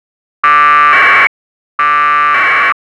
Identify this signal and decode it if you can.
Packet radio (AX.25, as in APRS), 1200 baud, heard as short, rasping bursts.